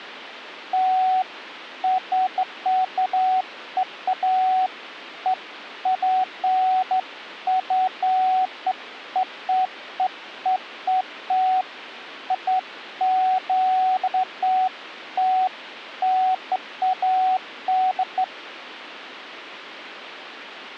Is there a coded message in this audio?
No, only beeps of irregular length.